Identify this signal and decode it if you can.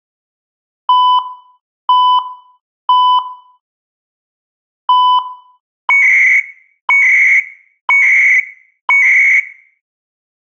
Radio time signal (CHU, Canada), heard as beeps and data bursts, one a second.